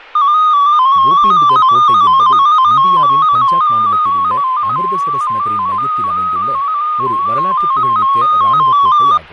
Multi-tone FSK (Olivia or MFSK type), about 250 Hz wide, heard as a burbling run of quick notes, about 15.625 baud, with fading and speech in Tamil.